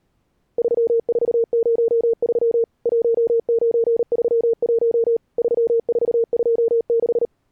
Morse code, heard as a keyed tone, machine-sent, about 38 wpm, 460 Hz. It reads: 3403 1931 3426